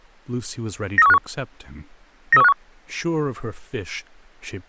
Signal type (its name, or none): five-tone selective call